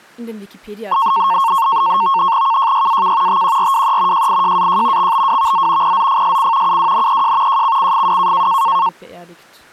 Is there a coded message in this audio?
Yes: NAVTEX (SITOR-B), 100 baud, 170 Hz shift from 0.9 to 8.9 s, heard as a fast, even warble, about 1000 Hz centre, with speech in German. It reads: KJYAK TQRWE JIJAJ XBWVZ PZFSC UWNEJ JCCFW